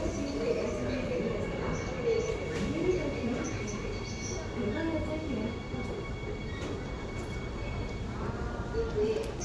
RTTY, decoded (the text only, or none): none